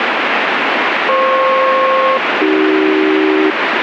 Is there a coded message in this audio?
Yes: aircraft SELCAL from 1.1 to 3.5 s, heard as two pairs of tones, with radio static. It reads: FP-AC